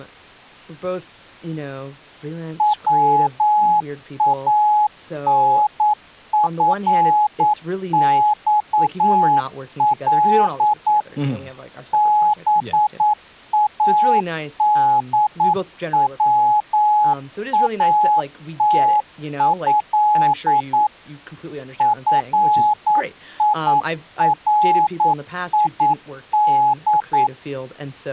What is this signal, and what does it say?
Morse code (Arabic alphabet), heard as a keyed tone, machine-sent, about 9 wpm, 840 Hz, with speech in English. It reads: وانفصل بادواته فيريد